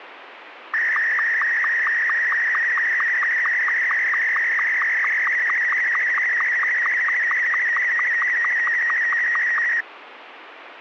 SSTV (slow-scan television), Martin M2, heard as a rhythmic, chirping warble, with radio static.